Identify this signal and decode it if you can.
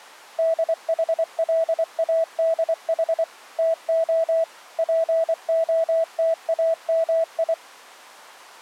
Morse code (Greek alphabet), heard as a keyed tone, machine-sent, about 24 wpm, 650 Hz. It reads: ΔΗΛΑΔΗ ΤΟ ΠΟΤΑΜΙ